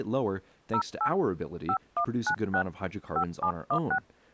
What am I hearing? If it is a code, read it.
DTMF, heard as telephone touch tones, dialled by hand, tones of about 80 ms, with speech in English. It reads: 08 5196 5716